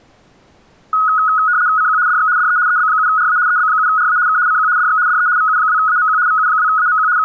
RTTY (75 baud, 170 Hz shift), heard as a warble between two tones, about 1360 Hz centre. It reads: CQ DX DE EB7RA EB7RA K CQ DX DE VU2AMQ VU2AMQ …